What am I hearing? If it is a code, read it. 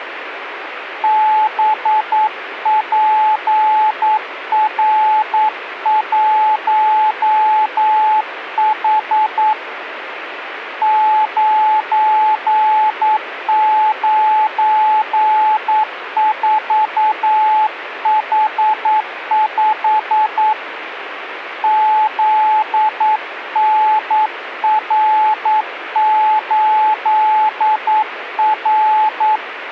Morse code, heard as a keyed tone, hand-sent with a paddle, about 9 wpm, 860 Hz, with radio static. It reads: BPR1H 994H5 ZNR8R